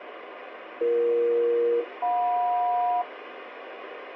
Aircraft SELCAL, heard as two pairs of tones, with radio hiss. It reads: BE-JM